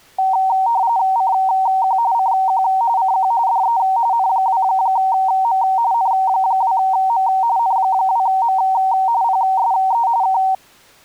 RTTY (45.45 baud, 170 Hz shift), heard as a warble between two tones, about 850 Hz centre. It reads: CQ CQ CQ DE N2M N2M N2M PSE K